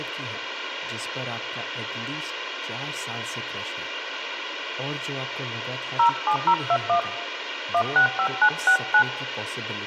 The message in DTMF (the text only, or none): 07021 165969